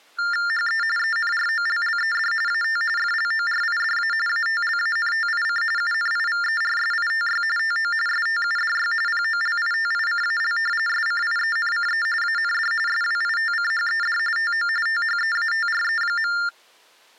TTY/TDD text telephone tones (45.45 baud Baudot), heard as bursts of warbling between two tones, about 400 Hz shift, 1600 Hz centre. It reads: HE ENROLLED AT FLORIDA ATLANTIC UNIVERSITY TO STUDY POLITICAL SCIENCE AND SWITCHED TO THEATRE.